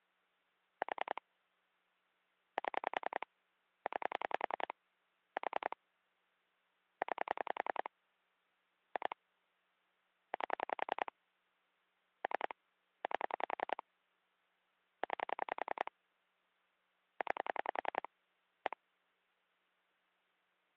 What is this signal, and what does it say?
Pulse dialling, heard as clicks on a phone line, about 10 pulses a second. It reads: 4 7 9 4 9 2 8 3 8 9 9 1